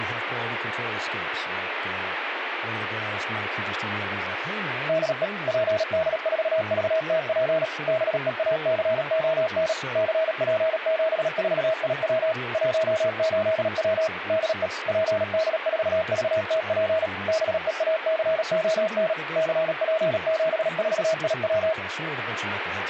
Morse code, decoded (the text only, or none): DE PD4VTP BEACON CP74IW 18W DE PD4VTP BEACON CP74IW